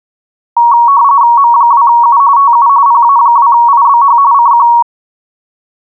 RTTY (45.45 baud, 170 Hz shift), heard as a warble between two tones, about 1030 Hz centre. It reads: M2U TU PA2IBH CQ